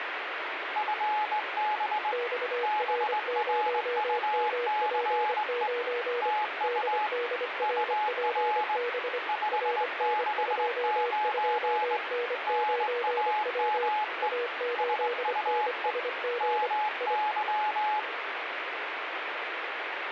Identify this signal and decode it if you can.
Morse code, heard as two keyed tones, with radio static. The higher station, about 20 wpm, 850 Hz: FB BRUCE TU UR 569 NAME SUE MY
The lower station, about 25 wpm, 480 Hz: XR0MP9 DDRPB RN22N9W A8NSG I